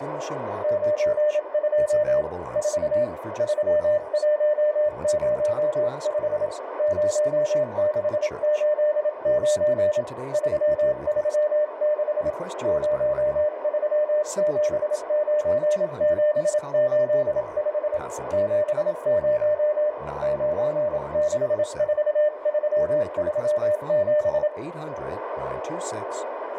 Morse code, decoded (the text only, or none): 92 4 3105 0689 336 0379785 70 964337